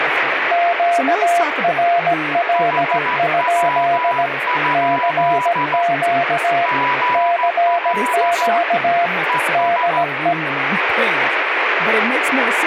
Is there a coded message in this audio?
Yes: Morse code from 0.5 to 10.4 s, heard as two keyed tones, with radio static and speech in English. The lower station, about 17 wpm, 690 Hz: QRL? CQ CQ DE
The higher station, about 14 wpm, 990 Hz: HW? GL ES